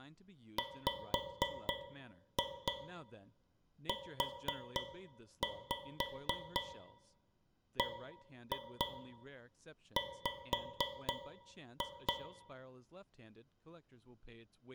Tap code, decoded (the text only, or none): WUBW